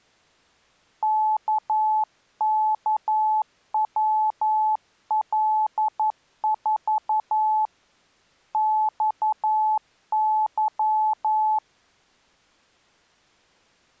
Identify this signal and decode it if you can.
Morse code, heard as a keyed tone, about 11 wpm, 860 Hz. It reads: KKWL4 XY